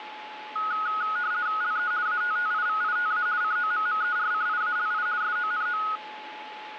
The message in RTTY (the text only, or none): LE ATTIVITA COMMERCIALI SONO